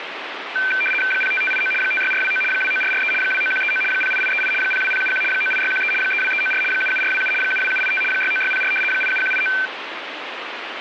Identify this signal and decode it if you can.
RTTY (75 baud, 850 Hz shift), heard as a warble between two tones, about 1950 Hz centre, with radio static. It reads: 05589 56429 29443 29139 08838 02071 98613 32394 77427 72785 69604 87189